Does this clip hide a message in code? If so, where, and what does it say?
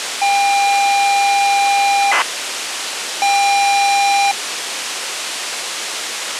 Yes: ZX Spectrum tape loading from 0.2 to 4.3 s, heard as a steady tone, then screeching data, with tape hiss.